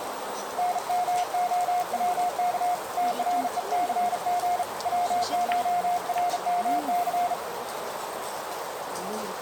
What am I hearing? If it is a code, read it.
Morse code (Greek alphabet), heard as a keyed tone, hand-sent with a bug key, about 36 wpm, 710 Hz, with radio static, a narrow filter and the noise of a restaurant. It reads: ΝΜΟΩΚ ΤΡΕΘΓ ΩΧΡΜΘ